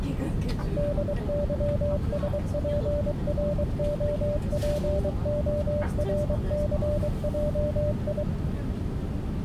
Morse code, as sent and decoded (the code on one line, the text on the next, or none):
-.. -.-- ... .--. .-. --- .--. --- .-. -.-. .--- ..
DYSPROPORCJI